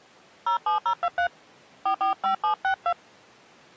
DTMF, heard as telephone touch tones, dialled by hand, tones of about 90 ms. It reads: 07023 445762